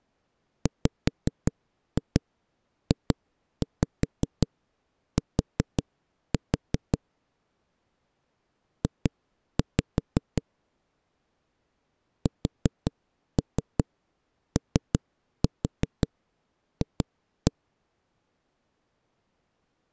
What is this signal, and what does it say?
Tap code, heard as knocks on a wall, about 5 knocks a second. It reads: WJT J SOF